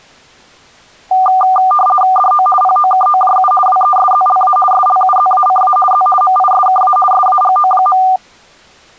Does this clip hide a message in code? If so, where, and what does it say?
Yes: RTTY (50 baud, 450 Hz shift) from 1.1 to 8.2 s, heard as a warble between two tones, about 980 Hz centre. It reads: DO POKOJU WESZLA SLUZACA Z MISKA SAGO.